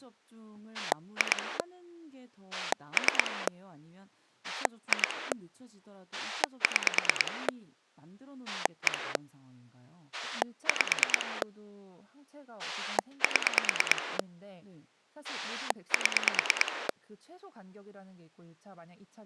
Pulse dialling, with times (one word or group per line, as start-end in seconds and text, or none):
0.7-1.6 2
2.5-3.5 3
4.4-5.3 2
6.1-7.5 6
8.5-9.2 1
10.1-11.4 5
12.6-14.2 7
15.2-16.9 7